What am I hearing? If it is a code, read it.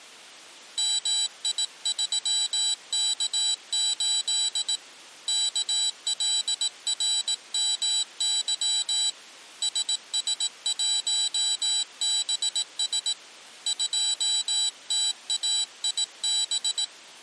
Morse code, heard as a high beeper, hand-sent with a paddle, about 18 wpm, 3950 Hz. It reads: MI3K8 KLRMY SS1BS 2TAIB